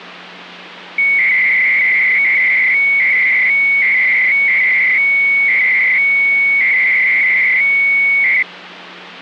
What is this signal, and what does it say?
300-baud modem data (Bell 103 tones), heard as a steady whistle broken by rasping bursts, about 300 baud, 200 Hz shift, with phone line noise.